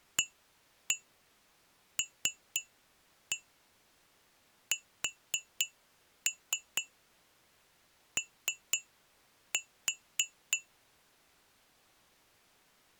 Tap code, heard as taps on glass, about 3 knocks a second. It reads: ALSO